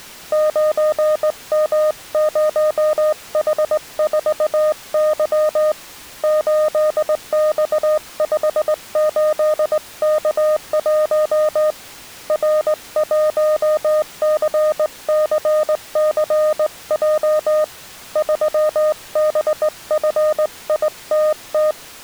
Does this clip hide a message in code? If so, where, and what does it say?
Yes: Morse code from 0.3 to 21.8 s, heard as a keyed tone, hand-sent with a straight key, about 19 wpm, 610 Hz. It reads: 9M0H4Y 8X58K1 R1CCCJ 3BFITT